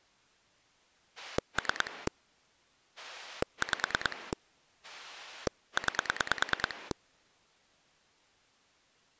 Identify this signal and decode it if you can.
Pulse dialling, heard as a rotary dial, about 9 pulses a second. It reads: 3 5 9